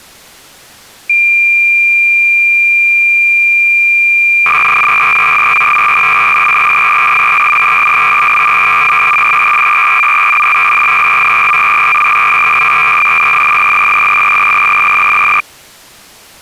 Cassette data (Kansas City type), 300 baud, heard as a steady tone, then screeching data.